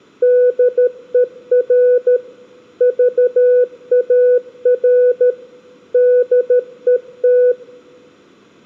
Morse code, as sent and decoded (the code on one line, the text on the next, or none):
-.. . .-. / ...- .- .-. / -.. . -
DER VAR DET